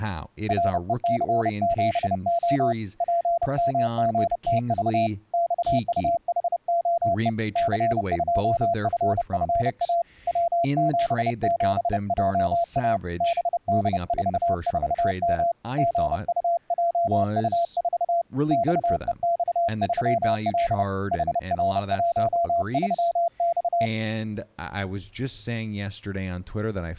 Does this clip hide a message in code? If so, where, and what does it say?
Yes: Morse code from 0.4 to 23.9 s, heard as a keyed tone, hand-sent with a paddle, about 30 wpm, 680 Hz, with speech in English. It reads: REC7O PMGTV XUHOE C2FFA W77JA BD44M GUJU4 XEX3L HR13X